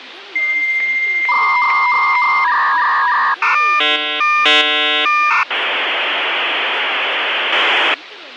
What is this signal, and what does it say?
Dial-up modem handshake (V.34 or later), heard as a whistle, warbles, then hiss, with phone line noise and speech in Sanskrit.